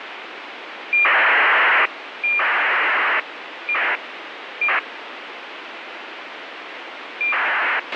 ACARS aircraft data, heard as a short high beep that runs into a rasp, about 2400 baud, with radio hiss and a squelch burst at the end.